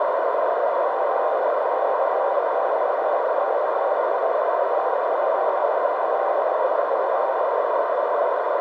Morse code (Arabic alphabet), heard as a keyed tone, hand-sent with a straight key, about 24 wpm, 780 Hz, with heavy radio static and a narrow filter. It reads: غعصكي تههءف